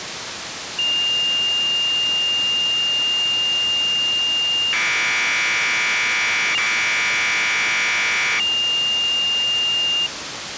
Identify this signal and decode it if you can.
Commodore tape loading (standard loader), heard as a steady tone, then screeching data, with tape hiss.